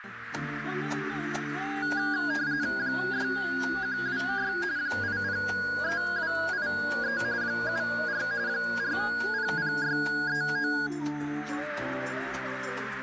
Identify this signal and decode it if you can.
RTTY (45.45 baud, 170 Hz shift), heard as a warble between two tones, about 1550 Hz centre, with radio static and a narrow filter. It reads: 6126 803283 74 400639